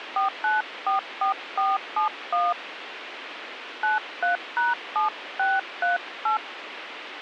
DTMF, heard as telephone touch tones, dialled by hand, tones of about 150 ms, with radio hiss. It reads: 4944471 93#7638